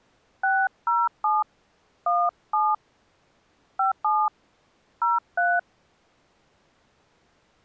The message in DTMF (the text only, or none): 607 17 57 03